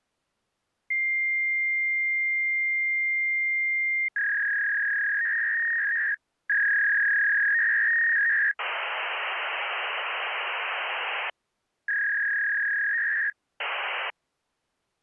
Fax machine handshake, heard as a long tone, a warble and hiss.